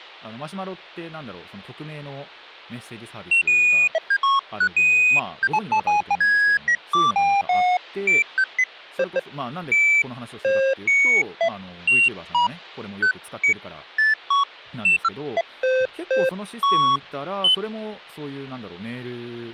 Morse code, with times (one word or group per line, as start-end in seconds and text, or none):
none